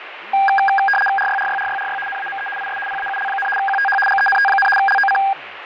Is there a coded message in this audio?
Yes: RTTY (75 baud, 850 Hz shift) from 0.3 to 5.3 s, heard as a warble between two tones, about 1210 Hz centre, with radio static, fading and speech in Bangla. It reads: RYRYRYRY NAME IS PAUL, QTH GENT, LOC